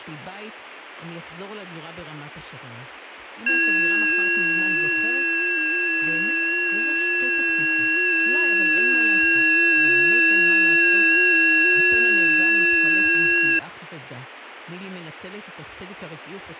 FT8 (several signals at once), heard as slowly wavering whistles, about 6.25 baud, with radio static.